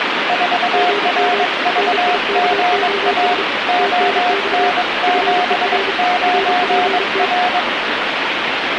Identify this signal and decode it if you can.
Morse code, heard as two keyed tones, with radio static. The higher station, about 22 wpm, 720 Hz: 4RVGA ON79R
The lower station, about 32 wpm, 400 Hz: GM NIKOS TNX FER RPT